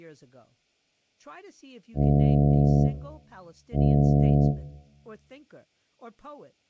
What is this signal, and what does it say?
Ship horn signal, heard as a ship's horn, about 70 Hz, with speech in English. 2 short. At sea: I am altering course to port.